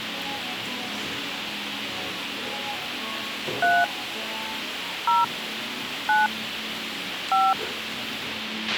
DTMF, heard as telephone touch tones, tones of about 190 ms, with radio hiss, a squelch burst at the end and the noise of a cafe. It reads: 3 0 9 5